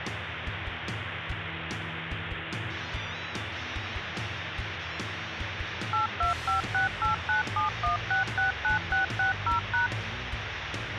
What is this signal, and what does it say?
DTMF, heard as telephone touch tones, dialled by machine, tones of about 130 ms, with phone line noise. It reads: 82568971669660#